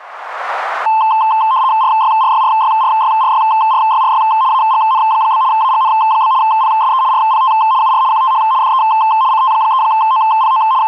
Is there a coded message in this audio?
Yes: RTTY (75 baud, 170 Hz shift) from 0.9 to 10.9 s, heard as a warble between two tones, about 960 Hz centre, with radio static. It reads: RYRYRYRYRYRYRY AGN? AGN? PSE RPT UR QTH DE CT3OPO …